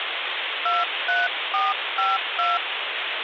DTMF, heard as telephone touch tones, dialled by hand, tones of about 190 ms, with phone line noise. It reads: 23452